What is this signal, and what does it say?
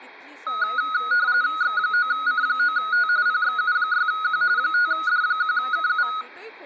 RTTY (45.45 baud, 170 Hz shift), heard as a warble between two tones, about 1360 Hz centre, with speech in Goan Konkani. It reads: X9C9T PXU6Q 5D1KU